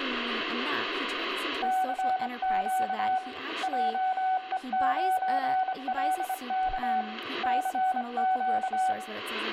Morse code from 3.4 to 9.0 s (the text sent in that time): JE9LK CQ